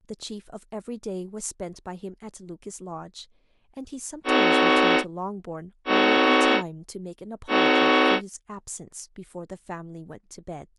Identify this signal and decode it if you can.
Train horn signal, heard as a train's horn, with speech in English. 3 short. On North American railways: when stopped, the train will back up.